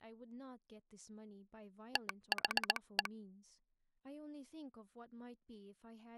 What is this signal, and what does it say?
Morse code (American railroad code), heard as a telegraph sounder, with speech in English. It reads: THE